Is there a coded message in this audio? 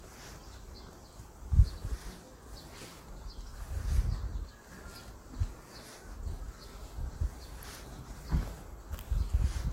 No, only the noise of a park.